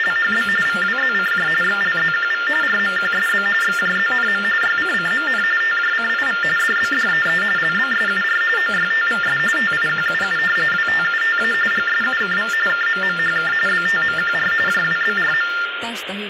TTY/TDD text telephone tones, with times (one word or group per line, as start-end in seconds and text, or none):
0.0-0.5 …
0.7-1.5 VWZCJ
1.6-2.5 XLZQV
2.6-3.5 RMQSB
3.6-4.4 XJZNM
4.6-5.4 YCCMN
5.6-6.4 TJCIV
6.6-7.4 DBDEE
7.6-8.4 LBSUR
8.6-9.4 OYTVS
9.6-10.4 TIQUU
10.7-11.5 WTUTA
11.7-12.5 GSUKV
12.7-13.5 KMMHK
13.7-14.5 BTMQR
14.7-15.5 JWBRM